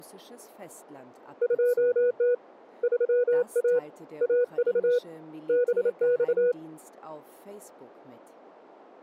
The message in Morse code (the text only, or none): 2T 3A AV BX